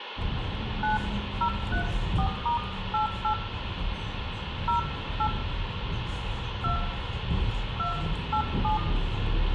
DTMF, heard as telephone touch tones, dialled by hand, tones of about 110 ms, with phone line noise, room echo and the noise inside a bus. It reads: 9034*88 08 2 287